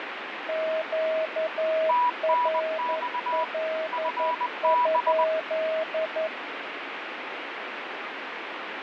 Morse code, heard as two keyed tones, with radio static. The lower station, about 11 wpm, 640 Hz: QRL?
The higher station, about 20 wpm, 980 Hz: TNX FB